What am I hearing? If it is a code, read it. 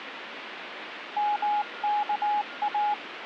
Morse code (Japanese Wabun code), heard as a keyed tone, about 19 wpm, 830 Hz, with radio static and a weaker station near 1410 Hz. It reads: ヨワイ